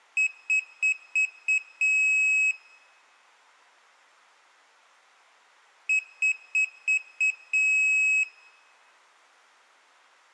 Beep code, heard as a piezo beeper, played twice, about 2550 Hz, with room echo. 5 short, 1 long.